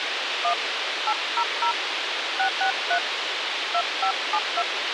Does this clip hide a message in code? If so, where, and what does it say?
Yes: DTMF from 0.4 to 4.6 s, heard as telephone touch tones, dialled by hand, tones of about 80 ms, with radio hiss. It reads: 1 800 663 2572